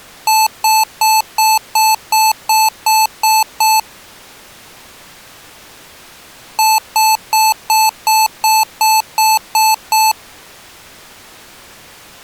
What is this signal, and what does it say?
Beep code, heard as beeps from a small speaker, played twice, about 870 Hz. 10 short. In AMI BIOS tables: CMOS shutdown register error.